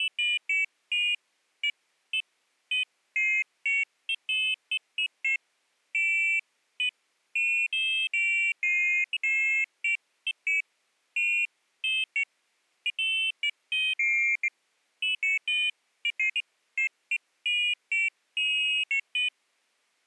Pairs of high tones at irregular times. There is no code.